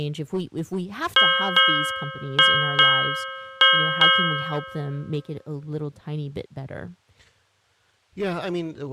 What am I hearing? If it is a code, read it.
Ship's bell, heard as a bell, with speech in English. 6. Six half-hours of the watch have passed.